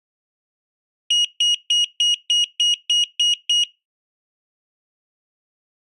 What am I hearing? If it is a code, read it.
Beep code, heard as a piezo beeper, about 2900 Hz. 9 short. In AMI BIOS tables: ROM checksum failure.